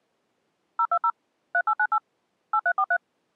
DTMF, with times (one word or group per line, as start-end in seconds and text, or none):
0.8-1.1 020
1.5-2.0 3898
2.5-3.0 8343